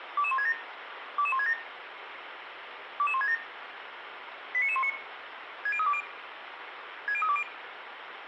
Five-tone selective call (ZVEI), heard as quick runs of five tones, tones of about 70 ms, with radio hiss and room echo. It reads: 22167 22167 22167 89919 60320 60320